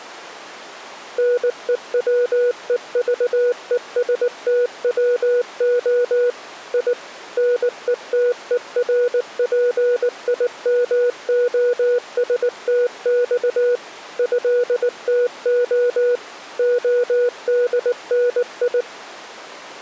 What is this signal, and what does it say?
Morse code (Russian alphabet), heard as a keyed tone, machine-sent, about 19 wpm, 490 Hz. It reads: НЕВЕЖЕСТВО И НЕТЕРПИМОСТЬ ЭТО ОДНИ